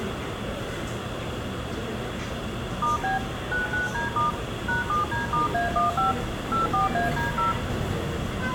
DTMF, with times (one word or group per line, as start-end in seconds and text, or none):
2.8-3.2 *B
3.5-4.3 99D*
4.7-6.1 #7D*A15
6.5-7.5 84AD0